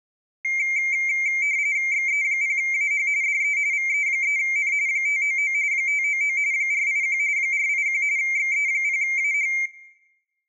RTTY (45.45 baud, 170 Hz shift), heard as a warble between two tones, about 2200 Hz centre, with room echo. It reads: XE0AH DE VE3N 599 599 481 481 XE0AH